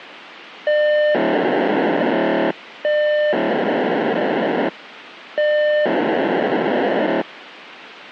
POCSAG pager data (1200 baud), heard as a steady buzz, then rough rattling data, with radio hiss.